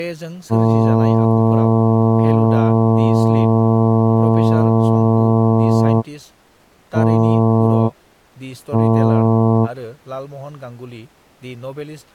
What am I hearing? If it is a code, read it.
Ship horn signal, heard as a ship's horn, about 110 Hz, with speech in Bodo. 1 long, 2 short. At sea: a vessel in fog that is sailing, fishing, towing or hampered.